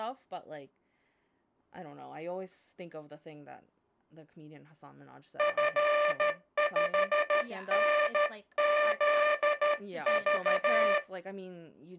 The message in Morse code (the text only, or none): F5NZV